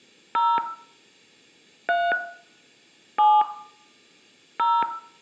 DTMF, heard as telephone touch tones, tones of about 230 ms, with room echo. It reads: 0 3 7 0